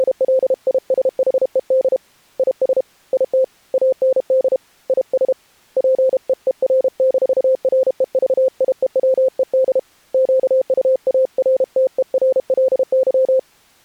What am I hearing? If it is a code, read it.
Morse code, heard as a keyed tone, hand-sent with a paddle, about 32 wpm, 520 Hz. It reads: … IS IT AND IS PEER-REVIEWED QUARTERLY